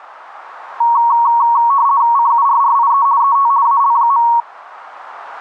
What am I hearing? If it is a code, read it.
RTTY (50 baud, 170 Hz shift), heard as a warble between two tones, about 1020 Hz centre. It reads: CURRIE ET AL.